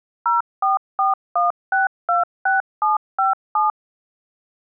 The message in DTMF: 0441626757

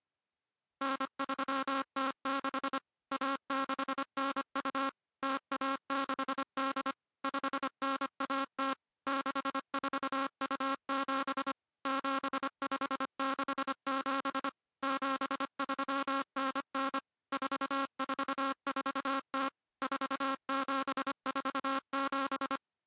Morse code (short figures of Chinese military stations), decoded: 9306 1692 0168 5910 6427 7567 7399 4440 4747

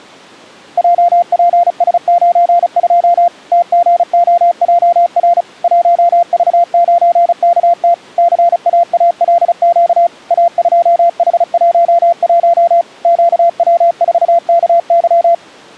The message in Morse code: JPS92 TGOJR 1V9KT CAALQ A2H11 QW4KY

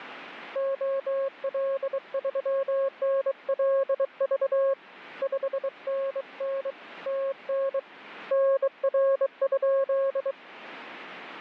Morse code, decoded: OL3NLV 5NN TN NR?

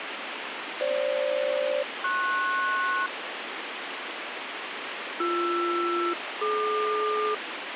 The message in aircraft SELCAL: FG-PS BR-DQ

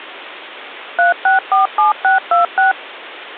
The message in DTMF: 3647626

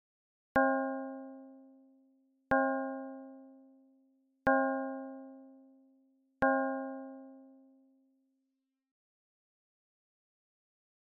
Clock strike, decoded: 4

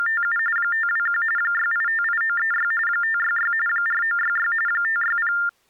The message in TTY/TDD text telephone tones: … 521 6858936 566 4966 560

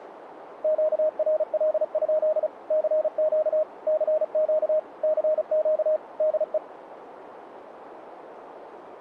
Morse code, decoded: QRL? CQ CQ CQ DE

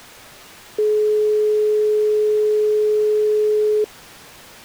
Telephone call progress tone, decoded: dial tone

